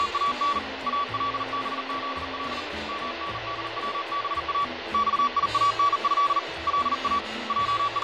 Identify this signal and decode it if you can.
Morse code (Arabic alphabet), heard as a keyed tone, hand-sent with a bug key, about 39 wpm, 1140 Hz, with radio static and fading. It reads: … البذل مندوبا صيانه لا …